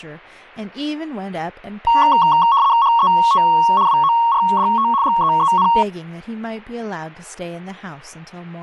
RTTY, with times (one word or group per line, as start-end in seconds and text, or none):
2.8-3.4 HET
3.9-4.9 WORDT
5.0-5.7 GEEN